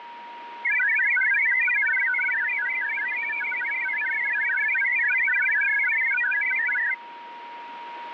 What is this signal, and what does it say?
Multi-tone FSK (Olivia or MFSK type), about 1000 Hz wide, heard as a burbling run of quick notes, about 62.5 baud, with radio static and a steady whistle near 950 Hz.